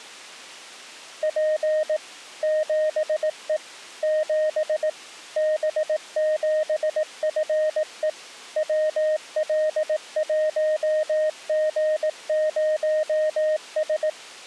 Morse code, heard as a keyed tone, machine-sent, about 18 wpm, 620 Hz. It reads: P 7E 7 B7FE WL1G0S